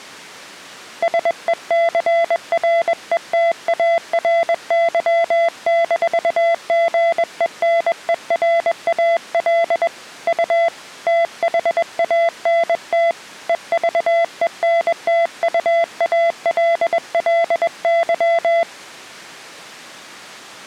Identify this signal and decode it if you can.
Morse code, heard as a keyed tone, hand-sent with a paddle, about 21 wpm, 670 Hz. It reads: SECRETARY-GENERAL U THANT EVENTUALLY